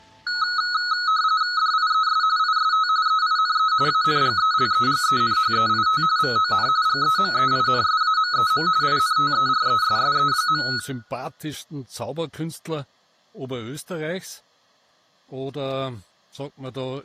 RTTY (45.45 baud, 170 Hz shift), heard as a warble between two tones, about 1370 Hz centre, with room echo. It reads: DIES IST EINE ANGELEGENHEIT VON GEMEINSAMEM INTERESSE.